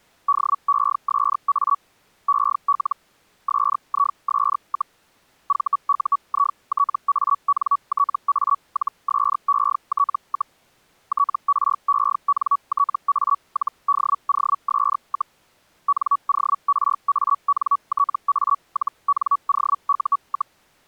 Hellschreiber (Feld-Hell, 122.5 baud), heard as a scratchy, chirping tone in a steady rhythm, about 1130 Hz. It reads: DESA EL SIS, VUITANTA-SET, TRENTA-DOS, NORANTA-NOU,